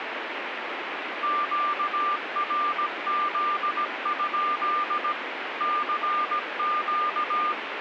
Morse code, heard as a keyed tone, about 17 wpm, 1200 Hz, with radio static. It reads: QRZ? CQ